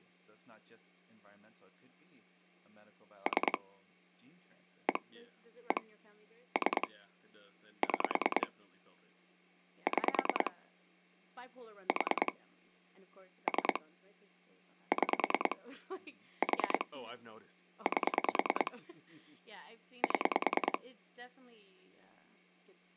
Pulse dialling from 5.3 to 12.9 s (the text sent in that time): 1 3 6 6 4